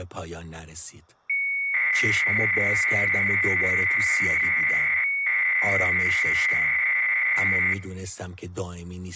300-baud modem data (Bell 103 tones), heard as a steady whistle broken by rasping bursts, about 300 baud, 200 Hz shift, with speech in Persian.